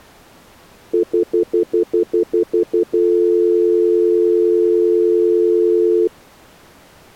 Telephone call progress tone (North American plan), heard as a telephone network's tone, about 350, 440 Hz, 0.1 s on and 0.1 s off. Stutter dial tone.